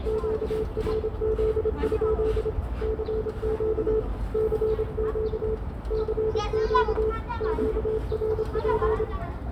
Morse code, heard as a keyed tone, hand-sent with a paddle, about 26 wpm, 440 Hz, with radio static, a narrow filter, room echo and the noise of a park. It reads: QRZ? CQ CQ CQ QRP